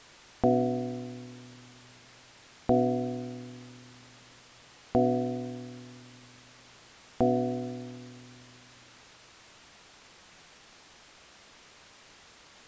Clock strike, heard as a bell. 4. Four o'clock.